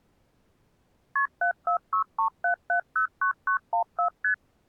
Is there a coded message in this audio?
Yes: multi-frequency trunk signalling (R1, as on North American trunks) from 1.2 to 4.3 s, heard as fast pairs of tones, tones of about 100 ms. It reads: KP 74637709914 ST